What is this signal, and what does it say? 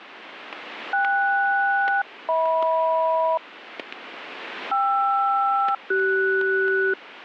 Aircraft SELCAL, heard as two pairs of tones, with static crashes. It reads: KS-HM KR-CS